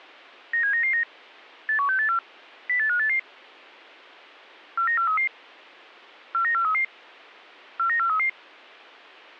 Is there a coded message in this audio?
Yes: five-tone selective call (CCIR) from 0.5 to 8.3 s, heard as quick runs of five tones, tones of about 100 ms. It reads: 97999 81684 08588 49433 49433 49433